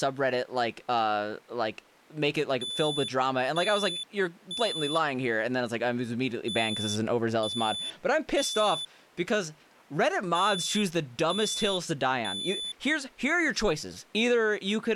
Alarm pattern, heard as an alarm's beeps, played three times, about 3500 Hz, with speech in English. Temporal three. Smoke or fire, evacuate.